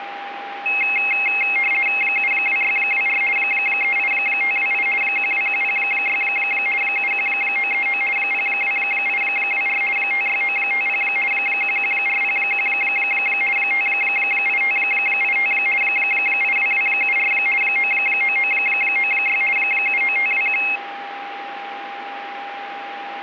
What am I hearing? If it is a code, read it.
RTTY (50 baud, 450 Hz shift), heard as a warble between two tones, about 2350 Hz centre, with radio static and a steady whistle near 800 Hz. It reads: 72624 38528 12106 71939 02824 56950 11401 58585 82274 99996 79521